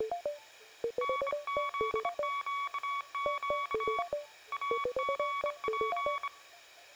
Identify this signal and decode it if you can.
Morse code (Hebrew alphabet), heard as a keyed tone, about 26 wpm, 1130 Hz, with room echo. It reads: נזקק אגף